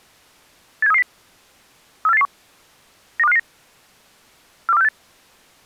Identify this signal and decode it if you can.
Five-tone selective call (EEA), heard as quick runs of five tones, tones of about 40 ms. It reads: 87330 34881 92559 42468